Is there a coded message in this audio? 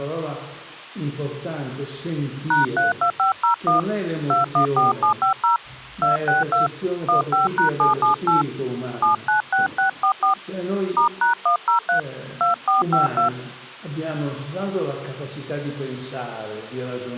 Yes: DTMF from 2.5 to 13.3 s, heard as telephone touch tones, dialled by hand, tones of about 120 ms. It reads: #32501 214750 262 15#778 796644 *#103 2452